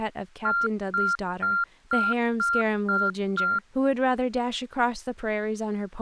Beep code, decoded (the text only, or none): 7 short